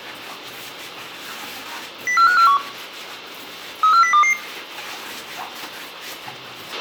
Five-tone selective call (CCIR), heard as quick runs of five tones, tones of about 100 ms, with a squelch burst at the end, room echo and kitchen noise. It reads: 04541 34022